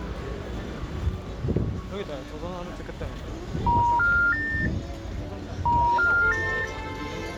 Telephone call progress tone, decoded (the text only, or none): special information tone